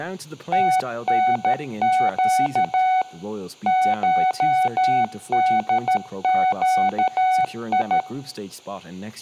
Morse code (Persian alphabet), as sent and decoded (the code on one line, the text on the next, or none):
- -. --.- / ---- -.. --.- ..
تنگ شدگی